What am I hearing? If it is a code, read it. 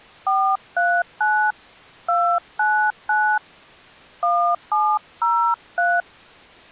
DTMF, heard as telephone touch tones, dialled by hand, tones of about 280 ms. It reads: 439 299 1703